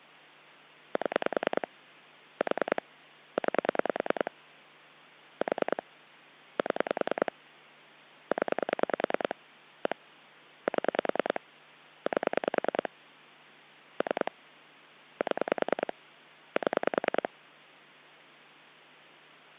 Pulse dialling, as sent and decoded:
7 / 4 / 9 / 4 / 7 / 10 / 1 / 7 / 8 / 3 / 7 / 7
7 4 9 4 7 0 1 7 8 3 7 7

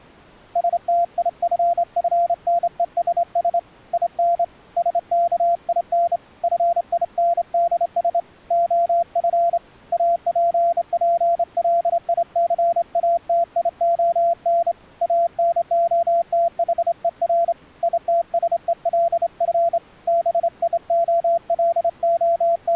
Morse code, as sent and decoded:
... - .. ..-. ..-. -. . ... ... / .. -. / ... -.- .. -. / ..-. .. -. -.. ... / --- ..-. / .- .--. .--. .-.. .. -.-. .- - .. --- -. / .- -. --- - .... . .-. / .. - ... . .-.. ..-. / …
STIFFNESS IN SKIN FINDS OF APPLICATION ANOTHER ITSELF …

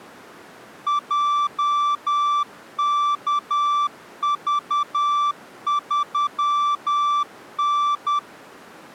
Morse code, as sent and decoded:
.--- -.- ...- ...-- -.
JKV3N

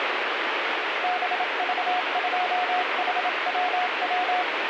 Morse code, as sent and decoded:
-... ...- ..--- .... .-- .--
BV2HWW

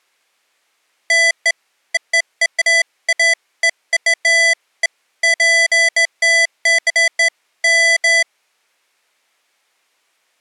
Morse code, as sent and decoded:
none

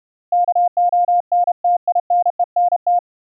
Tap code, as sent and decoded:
none

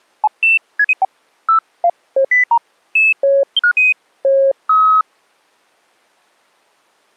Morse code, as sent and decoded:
none

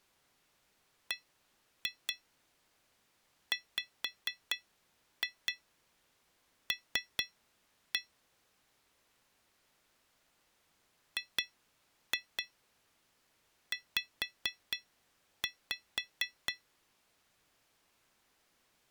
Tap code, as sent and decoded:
1-2 5-2 3-1 / 2-2 5-5
BWL GZ

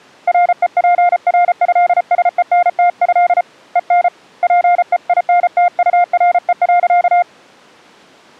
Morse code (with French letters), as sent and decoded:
.-. . .--. .-. ..-.. ... . -. - ..-.. / . -. / .--. . .. -. - ..- .-. . .-.-.-
REPRÉSENTÉ EN PEINTURE.

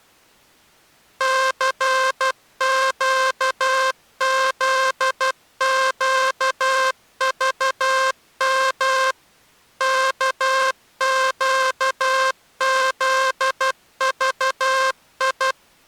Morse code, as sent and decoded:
-.-. --.- --.. --.- ...- -- / -.- --.- --.. ...- ..
CQZQVM KQZVI

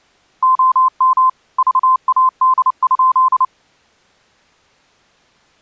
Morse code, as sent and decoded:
--- -- / ...- .- -.. ..--..
OM VAD?

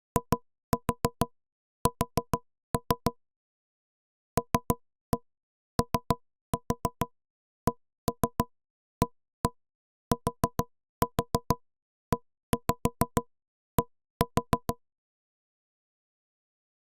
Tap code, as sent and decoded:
2-4 4-3 / 3-1 3-4 1-3 1-1 4-4 1-5 1-4
IS LOCATED

